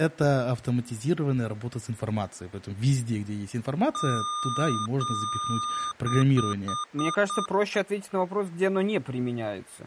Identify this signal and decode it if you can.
Beep code, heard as beeps from a small speaker, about 1210 Hz, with speech in Russian. 2 long, 5 short.